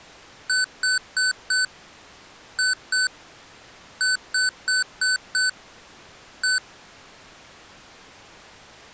Beep code, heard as beeps from a small speaker, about 1500 Hz. 4-2-5-1.